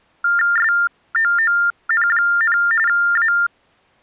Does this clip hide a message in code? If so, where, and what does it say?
Yes: TTY/TDD text telephone tones (45.45 baud Baudot) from 0.2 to 3.5 s, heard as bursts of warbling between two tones, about 400 Hz shift, 1600 Hz centre. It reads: SOON, A